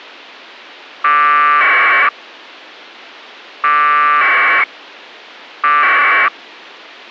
Packet radio (AX.25, as in APRS), 1200 baud, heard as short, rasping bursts.